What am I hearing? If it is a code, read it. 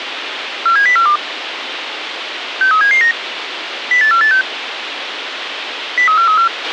Five-tone selective call (CCIR), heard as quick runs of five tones, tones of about 100 ms, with radio hiss and a squelch burst at the end. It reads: 47042 63779 08486 03434